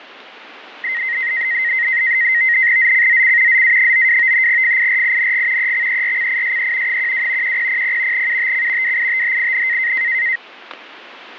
NAVTEX (SITOR-B), 100 baud, 170 Hz shift, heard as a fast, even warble, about 2000 Hz centre, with static crashes. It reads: ZCZC ZA92 FIRING EXERCISE 12 1000 UTC WITHIN